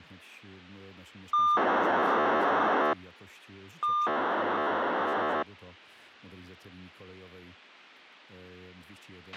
POCSAG pager data (2400 baud), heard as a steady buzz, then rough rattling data, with a squelch burst at the end.